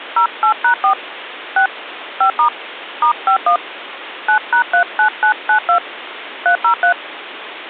DTMF, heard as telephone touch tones, dialled by hand, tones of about 100 ms, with phone line noise. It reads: 08#4 6 5* *51 9#39992 303